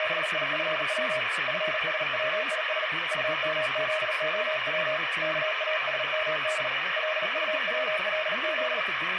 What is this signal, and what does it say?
Morse code, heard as a keyed tone, hand-sent with a paddle, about 38 wpm, 620 Hz, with radio static and speech in English. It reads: … FSWIS UMZOW KASMD LUWLZ